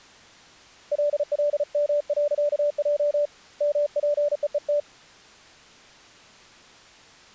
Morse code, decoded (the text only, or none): LLM.J MPEET